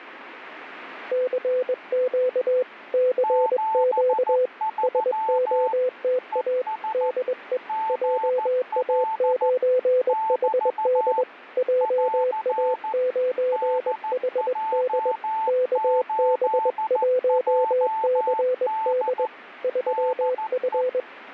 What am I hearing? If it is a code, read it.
Morse code, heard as two keyed tones. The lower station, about 21 wpm, 510 Hz: CQ CQ SOTA DE JA9HD JA9HD KB1CD 3F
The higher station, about 14 wpm, 880 Hz: 73 ES GL <BT> <AR> DJ8JD DE